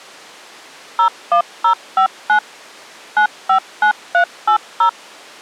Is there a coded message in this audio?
Yes: DTMF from 1.0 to 4.9 s, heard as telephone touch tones, dialled by machine, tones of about 90 ms. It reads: 01059 959380